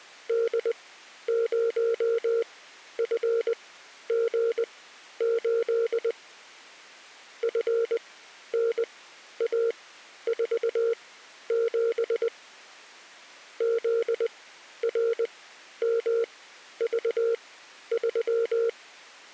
Morse code, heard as a keyed tone, machine-sent, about 20 wpm, spaced as for 11 wpm, 460 Hz. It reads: D0FG8 FNA47 ZRMV3